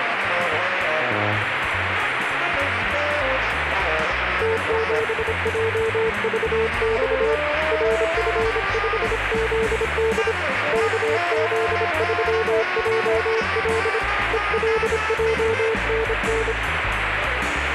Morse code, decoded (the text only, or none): T7JVX RF5ZD KZ3JL ELJNN